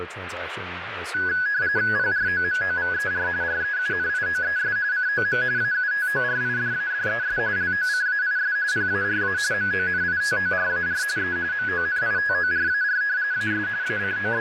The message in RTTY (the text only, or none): PROMOVER REUNIOES COM AUTORIDADES LOCAIS PARA MONITORAR E MONITORAR AS …